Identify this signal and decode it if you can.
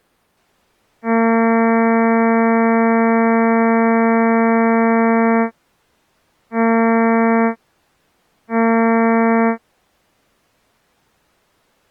Ship horn signal, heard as a ship's horn, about 230 Hz. 1 long, 2 short. At sea: a vessel in fog that is sailing, fishing, towing or hampered.